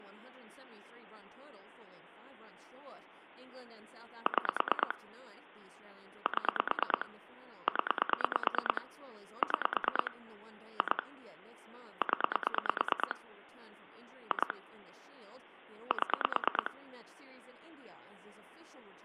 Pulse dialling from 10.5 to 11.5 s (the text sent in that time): 2